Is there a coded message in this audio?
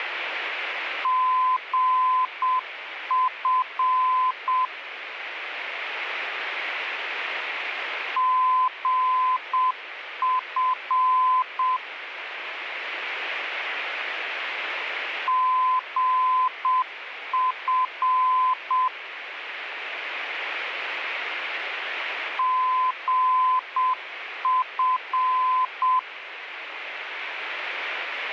Yes: Morse code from 1.0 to 26.1 s, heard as a keyed tone, machine-sent, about 7 wpm, 1020 Hz, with radio static. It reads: GF GF GF GF